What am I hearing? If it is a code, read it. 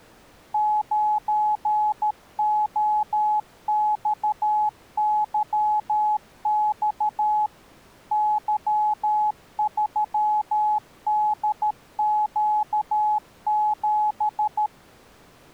Morse code, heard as a keyed tone, machine-sent, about 13 wpm, 850 Hz. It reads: 9OXYX Y3DQ7